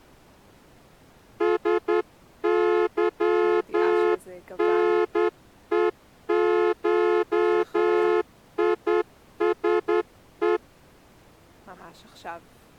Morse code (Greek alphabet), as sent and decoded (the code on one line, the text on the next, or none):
... -.-- -. . ---- .. ... .
ΣΥΝΕΧΙΣΕ